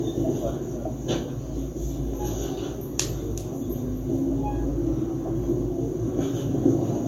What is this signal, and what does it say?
The noise inside a subway train. There is no code.